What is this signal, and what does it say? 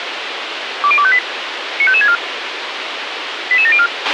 Five-tone selective call (ZVEI), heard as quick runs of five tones, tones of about 70 ms, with radio hiss and a squelch burst at the end. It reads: 20258 95564 88704